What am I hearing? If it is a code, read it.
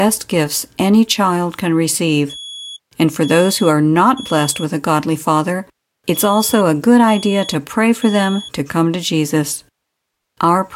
Alarm pattern, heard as an alarm's beeps, played twice, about 3350 Hz, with speech in English. Temporal three. Smoke or fire, evacuate.